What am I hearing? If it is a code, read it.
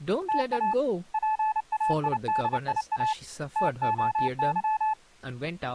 Morse code (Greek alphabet), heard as a keyed tone, hand-sent with a paddle, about 29 wpm, 870 Hz, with speech in English. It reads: ΤΑ ΠΑΙΔΙΑ ΤΟΥ